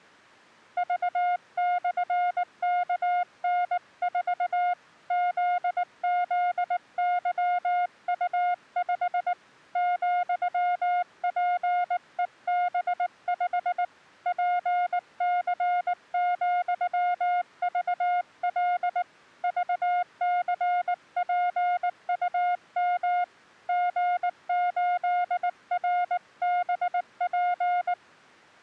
Morse code, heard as a keyed tone, hand-sent with a paddle, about 19 wpm, 710 Hz. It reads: V/KN4 ZZYU5 ,PEB5 PC,VL VCPUM G8RBP